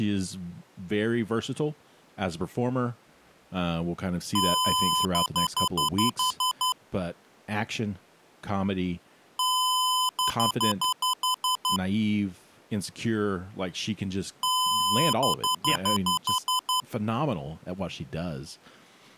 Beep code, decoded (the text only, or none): 1 long, 8 short